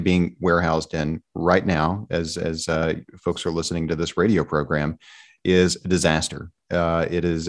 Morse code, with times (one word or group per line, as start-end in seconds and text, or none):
none